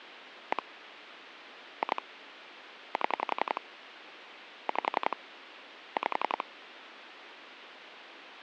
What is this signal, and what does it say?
Pulse dialling, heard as clicks on a phone line, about 11 pulses a second, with phone line noise. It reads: 1 2 7 5 5